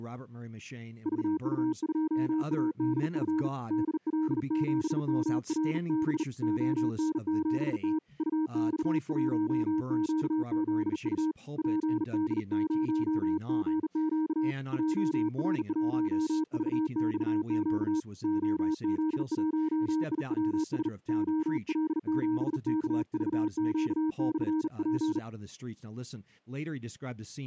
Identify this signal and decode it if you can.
Morse code, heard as a keyed tone, hand-sent with a bug key, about 39 wpm, 310 Hz, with speech in English. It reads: VU2ADF DL7MRB ON7T UX1QZU PD0GQ JR1VXQ OZ1IWS OL7KVQ/P